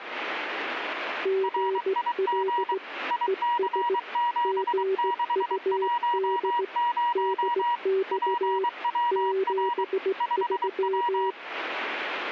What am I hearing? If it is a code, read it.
Morse code, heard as two keyed tones, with radio static. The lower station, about 17 wpm, 380 Hz: GL ES GUD DX 73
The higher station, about 23 wpm, 960 Hz: RIG IC7610 PWR 5W